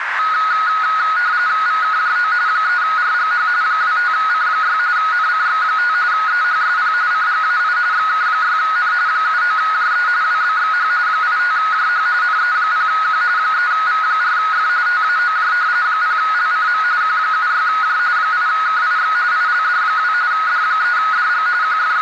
RTTY (45.45 baud, 170 Hz shift), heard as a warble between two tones, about 1360 Hz centre, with radio static and a narrow filter. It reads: VKJO 3RGH 25C6 NCX5 EHSP CGAI XK6N 79JE WBXH 85JH NE0Q 3V4F TAOJ 0LCM Q76J 8KIX ILD2 D3DG …